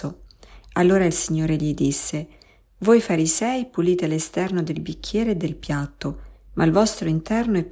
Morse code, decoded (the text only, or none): none